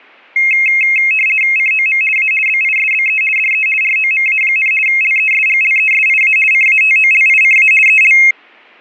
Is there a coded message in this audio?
Yes: RTTY (50 baud, 450 Hz shift) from 0.4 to 8.3 s, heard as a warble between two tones, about 2350 Hz centre. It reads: COM A BISBE DE ROMA, LESGLESIA CATOLICA EL